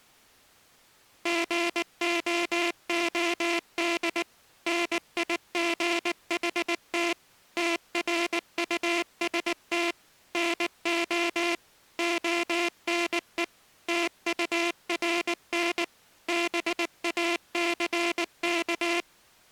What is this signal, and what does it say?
Morse code, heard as a buzzer, machine-sent, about 19 wpm. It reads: GOOD NIGHT TRUST NO ONE TURN BACK